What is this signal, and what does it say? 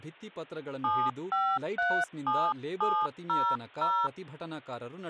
DTMF, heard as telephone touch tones, dialled by hand, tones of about 260 ms, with speech in Kannada. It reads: 7537700